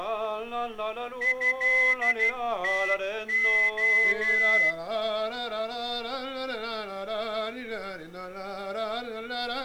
Morse code (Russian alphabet), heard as a whistle, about 12 wpm. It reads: ЭТО